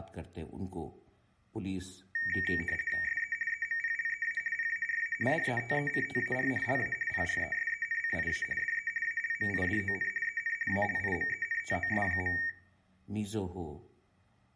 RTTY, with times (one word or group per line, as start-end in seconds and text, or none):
3.0-3.3 SE
3.5-4.4 EMPLEA
4.5-5.1 PARA
5.3-6.5 DETECTAR
6.6-6.9 LA
7.1-8.4 PRESENCIA
8.6-8.9 DE
9.0-10.1 ALMIDON
10.2-10.5 EN
10.7-12.3 ALIMENTOS.